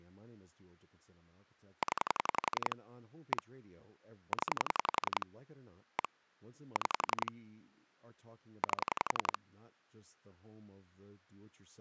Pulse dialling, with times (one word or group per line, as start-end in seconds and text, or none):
1.8-2.8 0
3.3-3.4 1
4.3-5.3 0
6.0-6.1 1
6.8-7.3 6
8.6-9.4 8